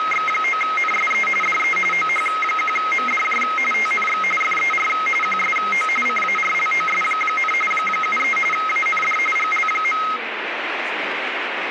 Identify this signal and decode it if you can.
RTTY (45.45 baud, 850 Hz shift), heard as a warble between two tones, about 1700 Hz centre, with radio static and speech in English. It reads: … DE OH1MDJ TNX FER QSO CARLOS, 73 AND GL.